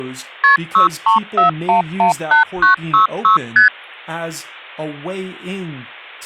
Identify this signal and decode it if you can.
Multi-frequency trunk signalling (R1, as on North American trunks), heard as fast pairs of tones, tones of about 120 ms, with speech in English. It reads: KP 634118966 ST